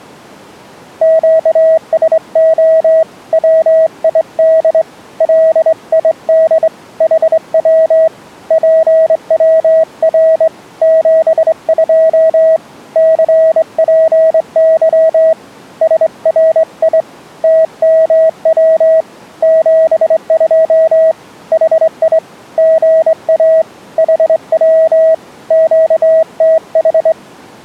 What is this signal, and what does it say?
Morse code, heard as a keyed tone, hand-sent with a straight key, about 23 wpm, 640 Hz. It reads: QSO WID LID HW PWR 72 CPY SRI TMW 72 HI GA HW QTH